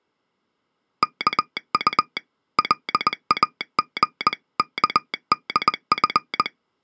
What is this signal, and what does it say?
Morse code (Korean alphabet), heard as a telegraph sounder, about 20 wpm. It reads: 이 곳은